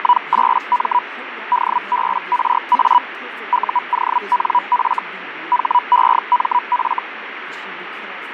Hellschreiber (Feld-Hell, 122.5 baud), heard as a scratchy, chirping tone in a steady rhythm, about 980 Hz, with radio static, fading and speech in English. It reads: … DBRA UONF HEMF